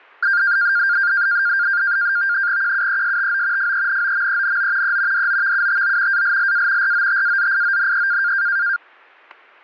NAVTEX (SITOR-B), 100 baud, 170 Hz shift, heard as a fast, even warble, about 1500 Hz centre, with static crashes. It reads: QUESTO FENOMENO E DOVUTO ALLA ROTAZIONE